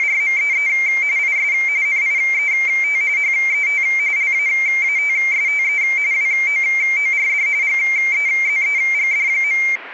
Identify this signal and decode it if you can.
RTTY (45.45 baud, 170 Hz shift), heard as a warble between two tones, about 2200 Hz centre, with radio static. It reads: … IS NIET HET LAATSTE WOORD GEZEGD.